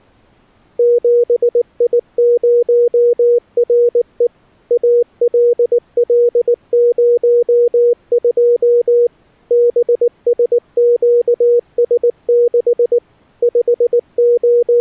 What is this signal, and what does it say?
Morse code, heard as a keyed tone, machine-sent, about 19 wpm, 480 Hz. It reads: 7I0RE ALL02 BSQS6 …